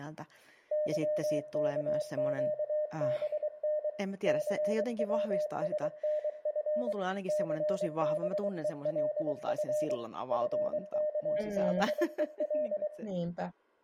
Morse code, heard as a keyed tone, machine-sent, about 23 wpm, 610 Hz, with room echo and speech in Finnish. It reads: YKQBN CWSNF CBELF FKBEL